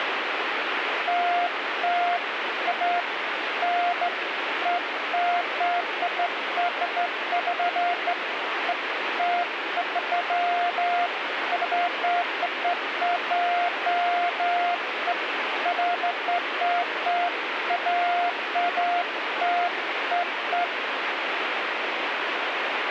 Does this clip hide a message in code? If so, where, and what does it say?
No, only beeps of irregular length, with radio static.